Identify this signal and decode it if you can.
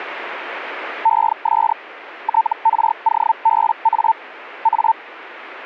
Hellschreiber (Feld-Hell, 122.5 baud), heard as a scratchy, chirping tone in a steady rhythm, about 900 Hz. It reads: ES TROBA A